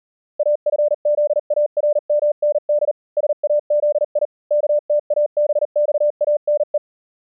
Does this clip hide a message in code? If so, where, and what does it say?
Yes: Morse code (Persian alphabet) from 0.3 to 6.8 s, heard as a keyed tone, machine-sent, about 39 wpm, spaced as for 36 wpm, 590 Hz. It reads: افزارمند سازی کتابخانه